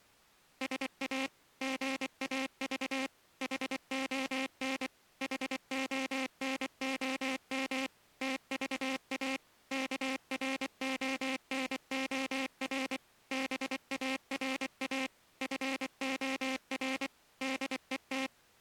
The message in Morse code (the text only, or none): SA GAV HON HONOM TVA KRONOR BARA FOR DET